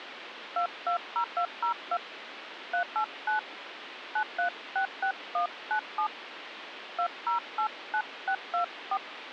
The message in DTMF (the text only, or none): 220202 389 9366197 2089624